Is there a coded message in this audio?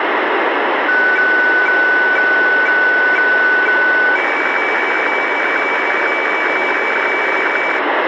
Yes: weather fax (radiofax), 120 lines a minute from 0.9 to 7.8 s, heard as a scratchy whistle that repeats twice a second, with radio static.